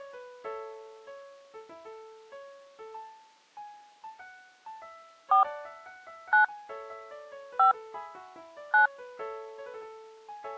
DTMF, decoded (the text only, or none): 4 9 5 9